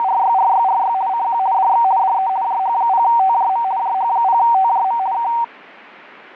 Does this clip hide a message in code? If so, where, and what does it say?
Yes: RTTY (50 baud, 170 Hz shift) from 0.0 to 5.4 s, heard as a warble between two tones, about 850 Hz centre. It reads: … CQ DX DE JH0TJM JH0TJM K